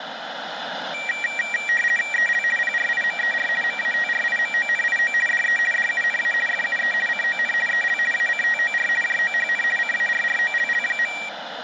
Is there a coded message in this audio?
Yes: RTTY (50 baud, 450 Hz shift) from 0.9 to 11.3 s, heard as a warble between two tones, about 2100 Hz centre, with radio static. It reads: EL PRIMER MATRIMONIO DE DUNA FUE CON EL ACTOR JOHN CARROLL.